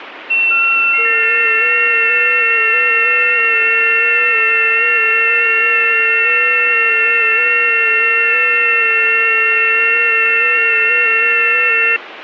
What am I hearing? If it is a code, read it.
FT8 (several signals at once), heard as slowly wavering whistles, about 6.25 baud, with radio static.